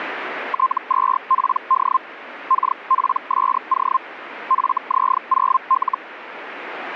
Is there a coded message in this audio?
Yes: Hellschreiber (Feld-Hell, 122.5 baud) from 0.5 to 6.0 s, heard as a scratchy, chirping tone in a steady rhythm, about 1050 Hz, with radio static. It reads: T2PD KPSO FZ0L